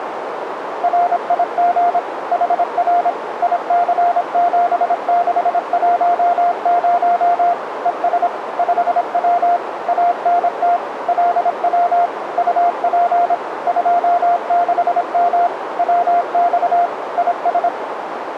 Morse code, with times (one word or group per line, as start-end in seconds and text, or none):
0.8-2.0 RIG
2.3-3.1 HR
3.4-7.5 IC7610
7.9-8.3 ES
8.6-9.6 5W
9.9-10.8 ANT
11.1-12.1 LW
12.4-13.3 UP
13.7-15.5 26M
15.8-16.9 WX
17.2-17.7 IS